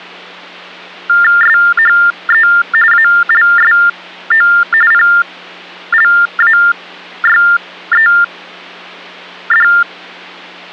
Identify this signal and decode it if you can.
TTY/TDD text telephone tones (45.45 baud Baudot), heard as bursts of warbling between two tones, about 400 Hz shift, 1600 Hz centre, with hum. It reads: SHE ALSO PLAYED